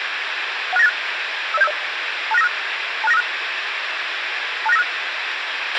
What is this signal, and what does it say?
Five-tone selective call (EIA), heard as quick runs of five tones, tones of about 30 ms, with radio hiss and a squelch burst at the end. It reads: 16986 50750 26956 26956 26956